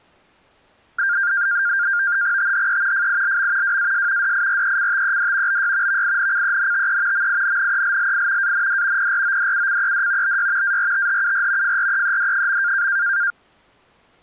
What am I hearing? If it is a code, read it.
NAVTEX (SITOR-B), 100 baud, 170 Hz shift, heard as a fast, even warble, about 1500 Hz centre. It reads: THE FILM WAS DIRECTED BY VINCENTE MINNELLI AND PRODUCED BY ARTHUR FREED.